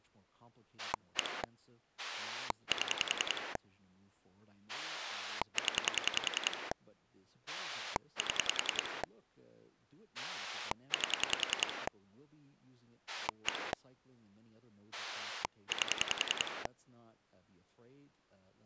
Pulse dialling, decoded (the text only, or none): 1 7 0 7 8 1 8